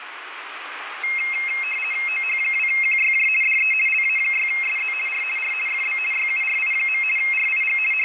RTTY (50 baud, 450 Hz shift), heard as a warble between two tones, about 2350 Hz centre, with radio static and room echo. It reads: OH2QYJ DE LA6SZ R R FB YURI. RIG …